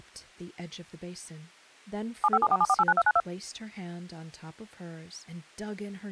DTMF, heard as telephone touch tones, dialled by machine, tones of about 50 ms, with speech in English. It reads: 75747489292